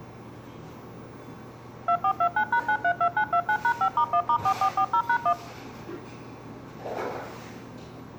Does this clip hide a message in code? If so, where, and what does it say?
Yes: DTMF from 1.9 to 5.3 s, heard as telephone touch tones, dialled by machine, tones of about 80 ms, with the noise of a cafe. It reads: 2429#932929#5*1*4440#1